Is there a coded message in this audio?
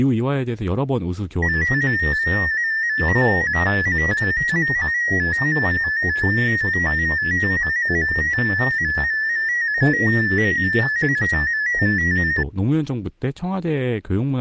Yes: multi-tone FSK (Olivia or MFSK type), about 250 Hz wide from 1.4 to 12.4 s, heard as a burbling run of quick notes, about 15.625 baud, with speech in Korean.